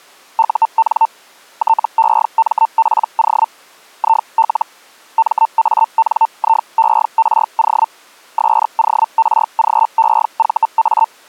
Hellschreiber (Feld-Hell, 122.5 baud), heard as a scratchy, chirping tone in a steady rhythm, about 900 Hz. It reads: UN TEMPO IL MANIERO SORGEVA